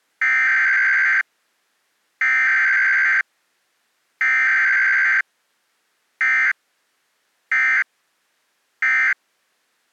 Emergency Alert System (SAME) tones (header bursts, then end-of-message bursts), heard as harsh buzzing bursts, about 520.83 baud.